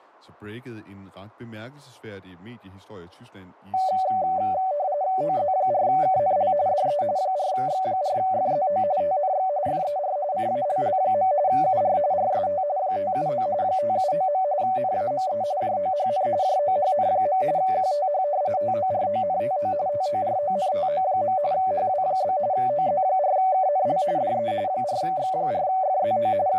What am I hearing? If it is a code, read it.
RTTY (45.45 baud, 170 Hz shift), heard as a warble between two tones, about 670 Hz centre, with speech in Danish. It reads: OZ4KNL DE 4X4FZO TNX FER CALL. UR RST 579 579. NAME JOHN JOHN. QTH TORONTO TORONTO. HW? OZ4KNL DE 4X4FZO …